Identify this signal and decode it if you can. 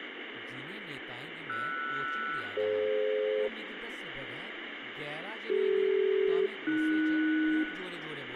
Aircraft SELCAL, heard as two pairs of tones, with radio static, room echo and speech in Dogri. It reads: RS-DF CD-AS